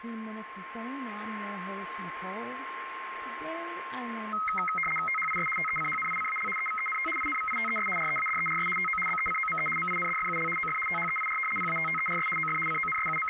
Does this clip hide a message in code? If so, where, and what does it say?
Yes: RTTY (75 baud, 850 Hz shift) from 4.3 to 13.3 s, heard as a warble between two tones, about 1700 Hz centre, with radio static, a steady whistle near 1060 Hz and speech in English. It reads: THIS TECHNICAL EVENT INVITES READERS TO BECOME MINDFUL OF THEIR PATTERS OF …